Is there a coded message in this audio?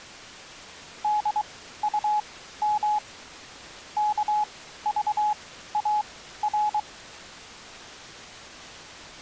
Yes: Morse code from 1.0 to 6.9 s, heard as a keyed tone, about 23 wpm, spaced as for 14 wpm, 840 Hz. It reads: DUM KVAR